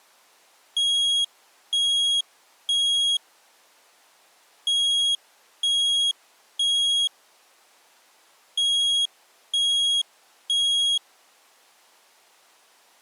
Alarm pattern, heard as an alarm's beeps, played three times, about 3300 Hz. Temporal three. Smoke or fire, evacuate.